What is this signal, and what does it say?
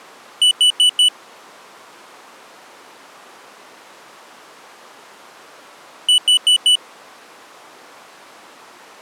Alarm pattern, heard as an alarm's beeps, played twice, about 2950 Hz. Temporal four. Carbon monoxide.